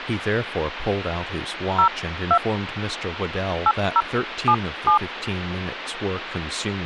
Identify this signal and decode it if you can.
DTMF, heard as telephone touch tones, dialled by hand, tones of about 80 ms, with phone line noise and speech in English. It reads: 02 8077